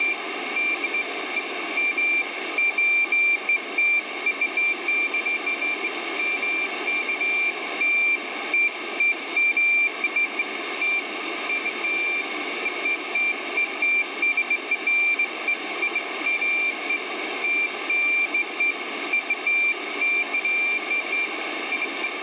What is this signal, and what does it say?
Beeps of irregular length, with radio static. There is no code.